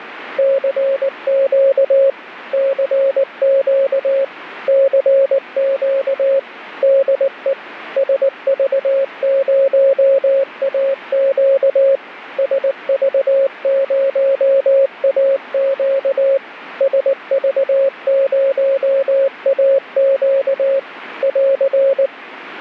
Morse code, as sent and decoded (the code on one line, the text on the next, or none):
-.-. --.- / -.-. --.- / -.-. --.- / -.. . / ... ...- ----- .- --.- / ... ...- ----- .- --.- / ... ...- ----- .- --.- / .-.-.
CQ CQ CQ DE SV0AQ SV0AQ SV0AQ <AR>